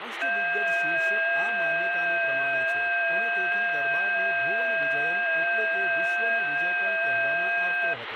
FT8 (several signals at once), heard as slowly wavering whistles, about 6.25 baud, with radio static and speech in Gujarati.